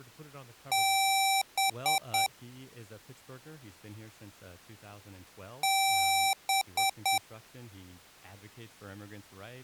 Beep code, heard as beeps from a small speaker, played twice, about 780 Hz, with speech in English. 1 long, 3 short. In Award and IBM BIOS tables: video adapter failure; in AMI BIOS tables: memory failure.